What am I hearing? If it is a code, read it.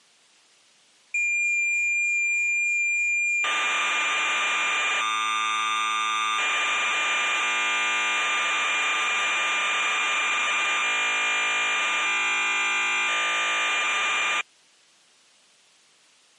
Cassette data (Kansas City type), 1200 baud, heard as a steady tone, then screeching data.